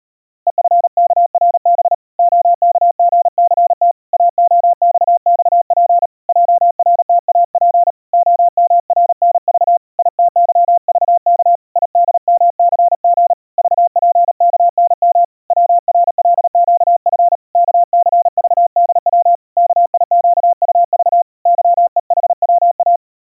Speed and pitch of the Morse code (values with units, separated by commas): 37 wpm, 690 Hz